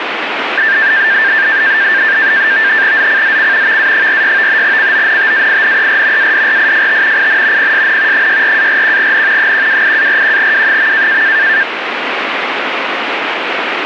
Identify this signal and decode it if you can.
NAVTEX (SITOR-B), 100 baud, 170 Hz shift, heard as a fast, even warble, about 1700 Hz centre, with radio static. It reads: ZCZC VA46 CONTAINER ADRIFT IN PSN 64-41N 128-41W.